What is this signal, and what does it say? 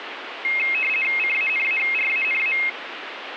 RTTY (50 baud, 450 Hz shift), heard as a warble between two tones, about 2350 Hz centre, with radio static. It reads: CANARANA